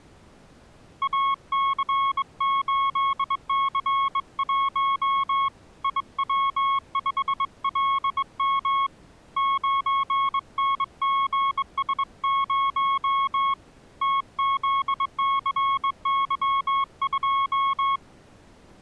Morse code, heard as a keyed tone, hand-sent with a straight key, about 22 wpm, 1100 Hz. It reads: AC8C1 IW5LM 9NGS0 TZCY2